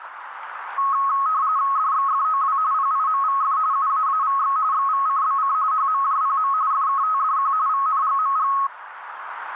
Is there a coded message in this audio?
Yes: RTTY (45.45 baud, 170 Hz shift) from 0.8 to 8.7 s, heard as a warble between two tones, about 1180 Hz centre, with radio static and a narrow filter. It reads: DXFOW PIMVF UAAVX XVCBC HMJPM FKTDQ VNGMG